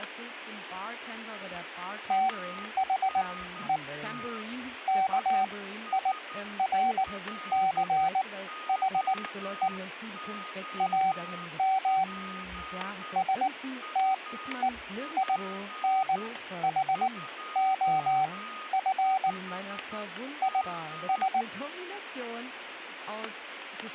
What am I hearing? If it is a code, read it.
Morse code, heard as a keyed tone, machine-sent, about 19 wpm, spaced as for 12 wpm, 760 Hz, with static crashes, a weaker station near 1240 Hz and speech in German. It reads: THE KIRCHE AM STEINHOF IS